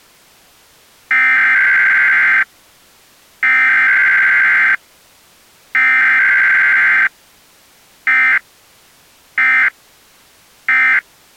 Emergency Alert System (SAME) tones (header bursts, then end-of-message bursts), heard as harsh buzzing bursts, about 520.83 baud.